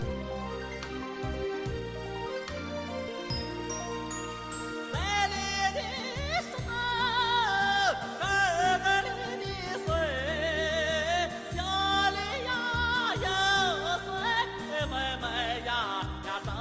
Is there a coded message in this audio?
No.